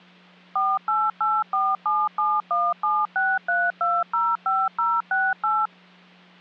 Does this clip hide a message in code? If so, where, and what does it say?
Yes: DTMF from 0.6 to 5.7 s, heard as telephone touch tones, dialled by machine, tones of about 220 ms, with hum. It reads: 4884771763205068